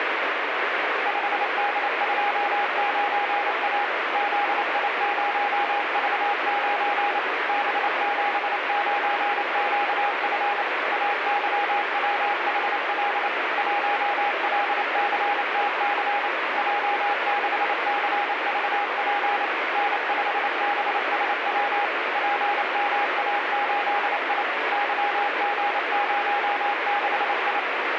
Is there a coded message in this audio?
Yes: Morse code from 1.0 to 27.7 s, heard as a keyed tone, machine-sent, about 28 wpm, 820 Hz, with heavy radio static. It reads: 5D29A ZI0V9 B79QF AYWHL 1LCTC J6CVP N5BSW PMA8I YG06I